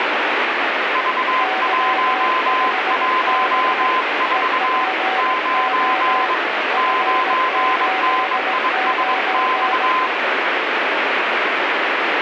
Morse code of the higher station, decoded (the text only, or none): V114 9 9NISX